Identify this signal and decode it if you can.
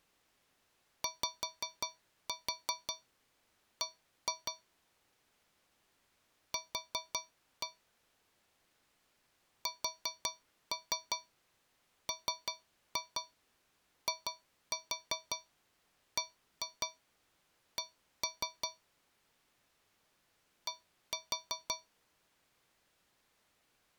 Tap code, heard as taps on a metal pipe, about 5 knocks a second. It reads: YB Q SMIBC D